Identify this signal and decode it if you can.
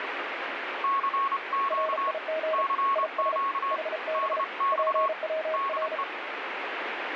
Morse code, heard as two keyed tones, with radio static. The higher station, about 28 wpm, 1100 Hz: CQ CQ DX DE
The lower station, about 34 wpm, 630 Hz: RIG IS HB PWR